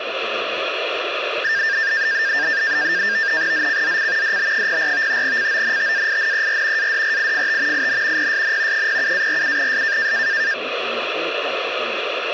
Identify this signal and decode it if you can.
NAVTEX (SITOR-B), 100 baud, 170 Hz shift, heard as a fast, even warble, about 1700 Hz centre, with radio static. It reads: ZCZC DB04 CONTAINER ADRIFT IN PSN 07-47S